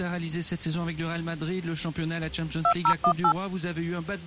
DTMF, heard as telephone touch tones, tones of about 80 ms. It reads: 2018